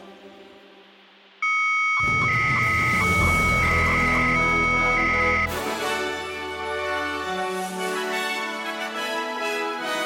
300-baud modem data (Bell 103 tones), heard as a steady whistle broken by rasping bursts, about 300 baud, 200 Hz shift.